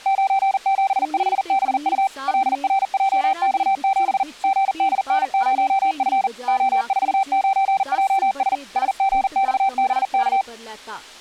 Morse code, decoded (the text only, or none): 975BU LRJX7 GDN0F O49JS SGXBK